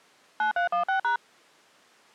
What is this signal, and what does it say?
DTMF, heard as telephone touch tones, dialled by machine, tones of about 110 ms. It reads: 9316#